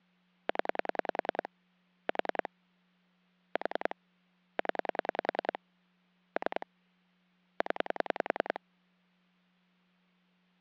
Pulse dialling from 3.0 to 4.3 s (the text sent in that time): 4